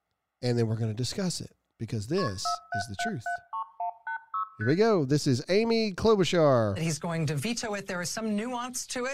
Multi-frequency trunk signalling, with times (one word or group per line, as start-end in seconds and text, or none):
2.2-2.3 KP
2.5-4.4 47773186
4.6-4.7 ST